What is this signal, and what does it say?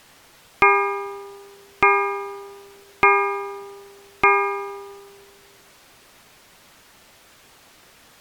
Clock strike, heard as a bell. 4. Four o'clock.